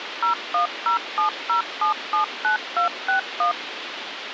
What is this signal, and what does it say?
DTMF, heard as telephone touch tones, dialled by machine, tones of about 110 ms, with radio hiss. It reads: 01070779261